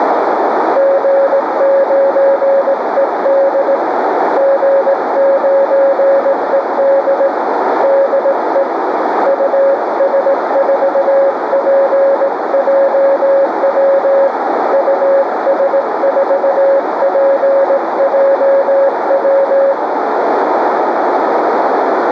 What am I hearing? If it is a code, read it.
Morse code, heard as a keyed tone, hand-sent with a straight key, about 18 wpm, 550 Hz, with radio static and a narrow filter. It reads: G9ED G9ED DE US4PJW US4PJW